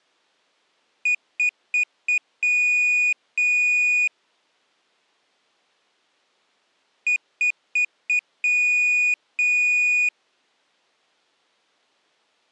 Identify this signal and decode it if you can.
Beep code, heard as a piezo beeper, played twice, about 2450 Hz. 4 short, 2 long.